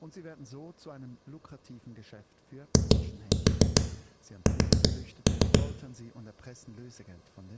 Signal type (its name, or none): tap code